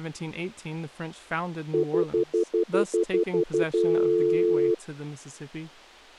Telephone call progress tone (North American plan), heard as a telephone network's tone, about 350, 440 Hz, 0.1 s on and 0.1 s off, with speech in English. Stutter dial tone.